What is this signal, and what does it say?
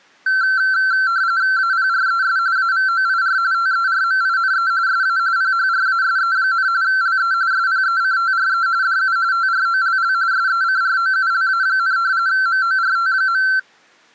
RTTY (45.45 baud, 170 Hz shift), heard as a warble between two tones, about 1450 Hz centre. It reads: APRES AVOIR TERMINE SA PHRASE, LE SPECTRE DU TROLL SECROULA, MORT.